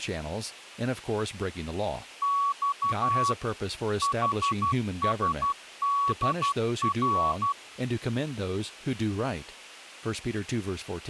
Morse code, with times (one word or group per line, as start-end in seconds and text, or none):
2.2-3.3 X
4.0-7.5 HSDR